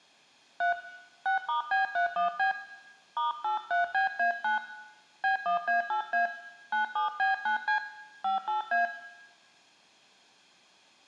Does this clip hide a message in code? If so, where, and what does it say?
Yes: DTMF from 0.6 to 8.9 s, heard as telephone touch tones, dialled by hand, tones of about 120 ms, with room echo. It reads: 3 6*B31B *83BA9 B1A8A 97B9C 58A